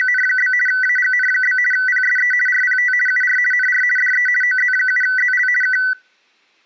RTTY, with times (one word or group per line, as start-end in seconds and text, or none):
0.0-0.5 …
0.7-1.6 AGN?
1.7-2.3 PSE
2.5-2.9 RPT
3.1-3.4 UR
3.5-3.8 NR
4.0-4.3 DE
4.4-5.5 OZ7ZL
5.6-5.8 K